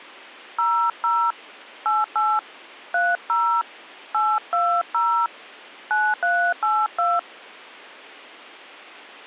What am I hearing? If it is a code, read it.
DTMF, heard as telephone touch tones, dialled by hand, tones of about 250 ms. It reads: 00 88 30 820 9382